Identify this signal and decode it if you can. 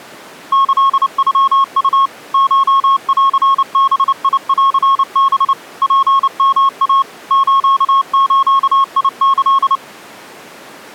Morse code (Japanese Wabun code), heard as a keyed tone, machine-sent, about 29 wpm, 1090 Hz. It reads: キノウ コンバンハ ツヨイ スズキ